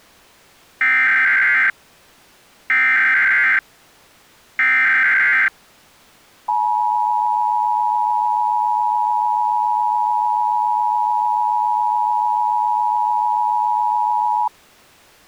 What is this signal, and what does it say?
Emergency Alert System (SAME) tones (header bursts, then the 853 and 960 Hz attention tone), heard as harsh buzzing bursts, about 520.83 baud.